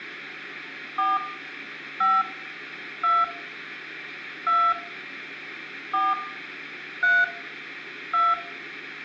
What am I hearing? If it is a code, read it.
DTMF, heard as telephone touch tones, dialled by hand, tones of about 240 ms, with room echo. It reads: 4 5 2 2 4 3 2